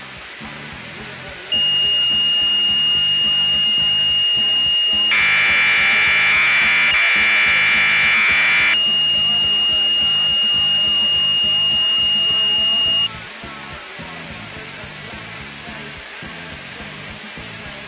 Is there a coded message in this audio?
Yes: Commodore tape loading (standard loader) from 1.5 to 13.1 s, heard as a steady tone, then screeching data.